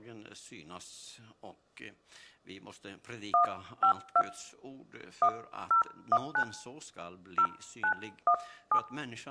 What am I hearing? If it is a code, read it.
DTMF, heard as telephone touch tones, dialled by hand, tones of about 90 ms, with room echo. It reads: 152 1019 0917